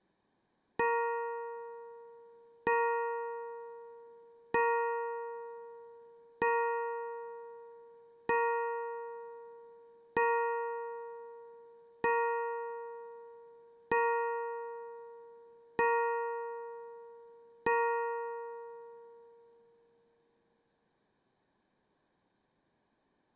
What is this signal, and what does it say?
Clock strike, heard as a bell, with room echo. 10. Ten o'clock.